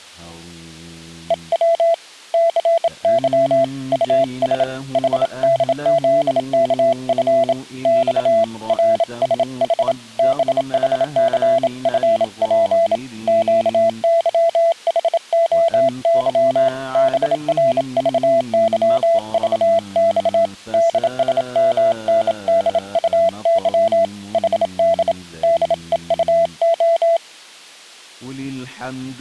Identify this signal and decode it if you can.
Morse code, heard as a keyed tone, hand-sent with a bug key, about 27 wpm, 670 Hz. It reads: EW CY US HDZKF X RSH BHCFP QYHOY BRVYVX DSMNDUY HD DEUO